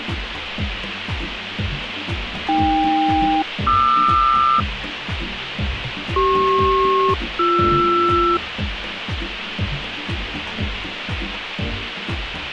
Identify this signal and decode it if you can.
Aircraft SELCAL, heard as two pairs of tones, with radio hiss. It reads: AK-QR CP-BR